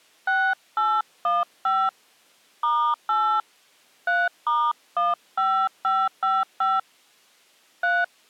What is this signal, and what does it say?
DTMF, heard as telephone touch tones, dialled by hand, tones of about 240 ms. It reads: 6815 *8 3*15555 3